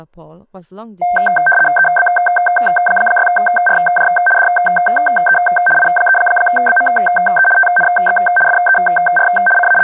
RTTY (75 baud, 850 Hz shift), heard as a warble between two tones, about 1130 Hz centre, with speech in English. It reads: EB6RJ DE I3BME TNX FER …